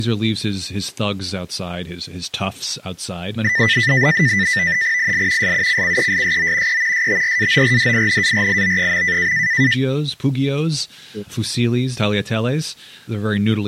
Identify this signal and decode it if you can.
NAVTEX (SITOR-B), 100 baud, 170 Hz shift, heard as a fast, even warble, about 1900 Hz centre, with speech in English. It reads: IL SUCCESSO E STRAORDINARIO.